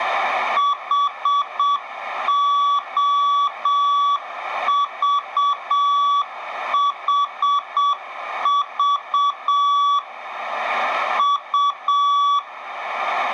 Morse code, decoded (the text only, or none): HOVHV U